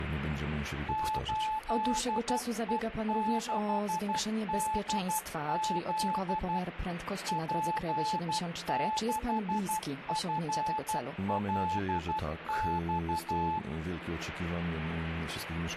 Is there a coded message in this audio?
Yes: Morse code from 0.8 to 13.6 s, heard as a keyed tone, machine-sent, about 12 wpm, 870 Hz. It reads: 8E6DZ P6FLX